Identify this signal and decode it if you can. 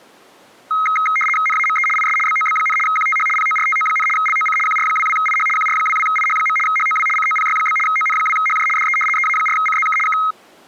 RTTY (75 baud, 850 Hz shift), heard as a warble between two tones, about 1700 Hz centre. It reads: NAME IS BOB, QTH PORTO, LOC QR22IH QR22IH. HOW COPY? ON2HJ DE EA4CZK K